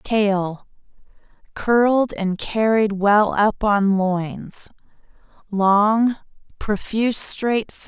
Speech in English. There is no code.